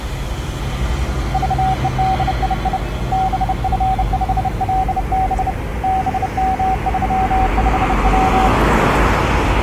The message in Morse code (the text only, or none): VEDII BF5LB BM35W